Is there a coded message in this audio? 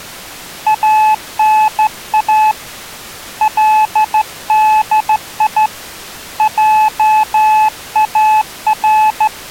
Yes: Morse code (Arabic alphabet) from 0.6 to 9.3 s, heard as a keyed tone, hand-sent with a straight key, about 14 wpm, 860 Hz. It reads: انا لدي جار